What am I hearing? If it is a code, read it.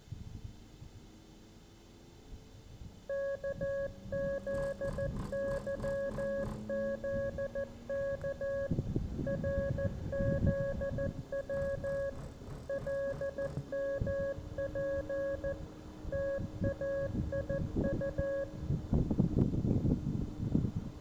Morse code, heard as a keyed tone, machine-sent, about 14 wpm, 550 Hz, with room echo. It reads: KZYZK RZW LMP TAIU